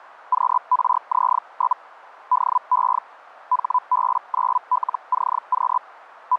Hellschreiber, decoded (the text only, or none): QRZ? DE HB9LCQ …